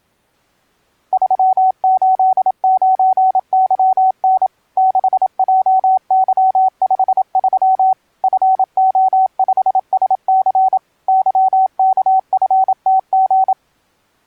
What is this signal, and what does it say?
Morse code, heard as a keyed tone, machine-sent, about 27 wpm, 760 Hz. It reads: 389YN 6JY53 FO5SC YKFTG